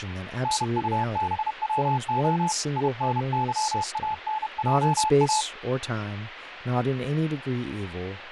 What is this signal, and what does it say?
Morse code, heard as a keyed tone, hand-sent with a paddle, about 31 wpm, 870 Hz, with radio static and speech in English. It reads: NUBWO INYANJA